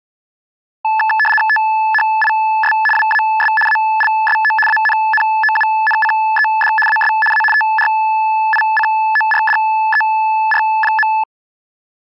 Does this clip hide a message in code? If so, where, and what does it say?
Yes: RTTY (75 baud, 850 Hz shift) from 0.8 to 11.2 s, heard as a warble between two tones, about 1300 Hz centre. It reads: THIS WAS ALSO ANNOUNCED AS A TRICORDER.